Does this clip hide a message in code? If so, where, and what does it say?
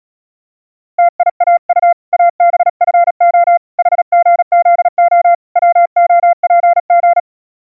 Yes: Morse code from 0.9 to 7.3 s, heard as a keyed tone, hand-sent with a paddle, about 37 wpm, 690 Hz. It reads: TIAU ABFO HGZO WOPG